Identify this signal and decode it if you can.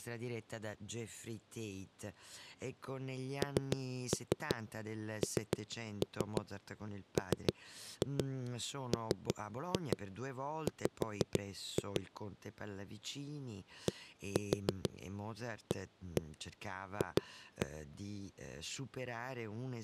Tap code, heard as knocks on a wall, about 6 knocks a second, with speech in Italian. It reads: NNMMW DAF